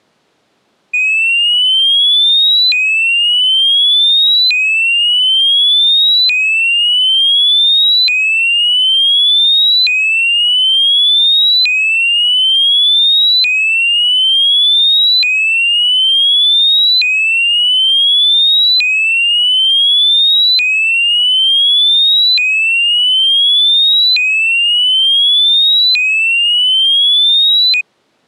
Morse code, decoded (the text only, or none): none